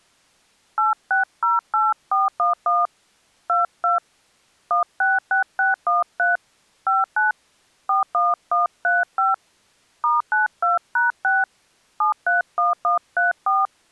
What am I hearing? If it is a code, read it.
DTMF, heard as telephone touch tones, dialled by hand, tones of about 160 ms. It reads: 8608411 22 166613 59 41135 *92#6 731134